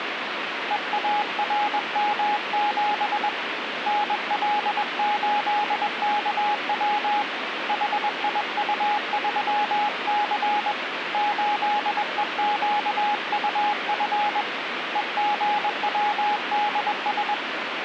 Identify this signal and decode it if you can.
Morse code, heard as a keyed tone, hand-sent with a paddle, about 21 wpm, 830 Hz, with radio static. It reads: EARM7 NL8KW HIU3C 8EQUF EGWDS